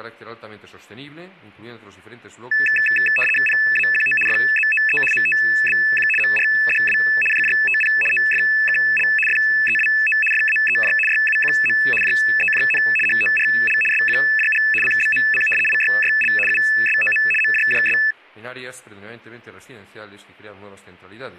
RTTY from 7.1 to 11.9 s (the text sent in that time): JJTP OFKL FEWO FAEJ YUQM